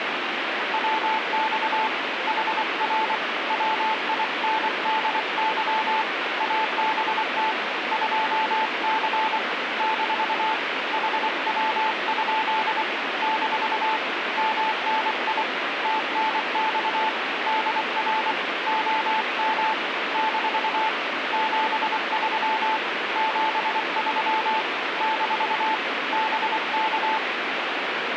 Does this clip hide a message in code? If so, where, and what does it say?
Yes: Morse code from 0.7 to 27.2 s, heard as a keyed tone, hand-sent with a paddle, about 24 wpm, 880 Hz, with radio static. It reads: WX HR WINDY ABT 2C - HW? - MNI TNX DR OM - 73 73 - BK